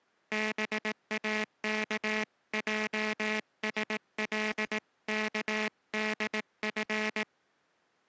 Morse code (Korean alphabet), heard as a buzzer, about 18 wpm. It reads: 동혁은